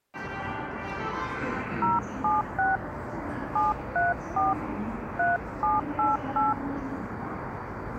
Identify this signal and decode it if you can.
DTMF, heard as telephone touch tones, dialled by hand, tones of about 170 ms, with the noise of a subway station. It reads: 076 734 3788